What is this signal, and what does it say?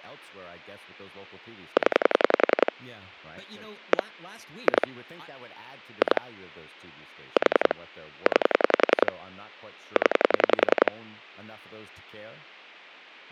Pulse dialling, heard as clicks on a phone line, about 10 pulses a second, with speech in English. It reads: 0 1 2 2 4 9 0